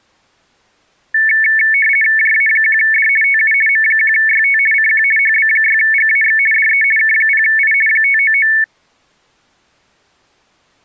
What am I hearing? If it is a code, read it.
RTTY (50 baud, 450 Hz shift), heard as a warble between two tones, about 2000 Hz centre. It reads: JA1D TU M1YT CQ HB6GAX DE K0I 599